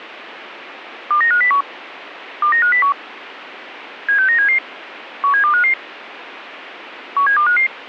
Five-tone selective call (CCIR), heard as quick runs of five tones, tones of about 100 ms, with radio hiss. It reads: 29501 29501 76977 17255 17255